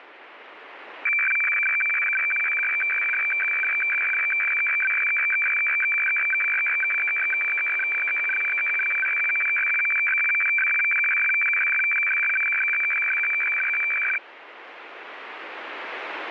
Weather fax (radiofax), 120 lines a minute, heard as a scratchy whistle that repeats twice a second, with radio static.